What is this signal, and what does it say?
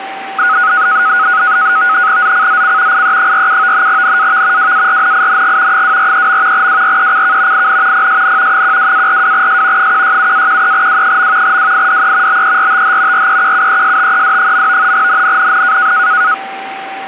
NAVTEX (SITOR-B), 100 baud, 170 Hz shift, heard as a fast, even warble, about 1360 Hz centre, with radio static and a steady whistle near 780 Hz. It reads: ZCZC IE47 NAV WARNING 243. WRECK IN PSN 12-42S 167-13W. WIDE BERTH REQUESTED. NNNN